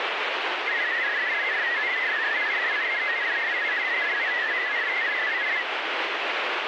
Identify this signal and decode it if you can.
Multi-tone FSK (Olivia or MFSK type), about 500 Hz wide, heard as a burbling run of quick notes, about 62.5 baud, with radio static.